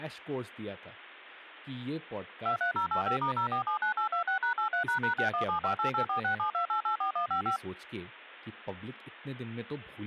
DTMF, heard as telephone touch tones, dialled by machine, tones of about 110 ms, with speech in Hindi. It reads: 23085*0479826#83##6175884672884155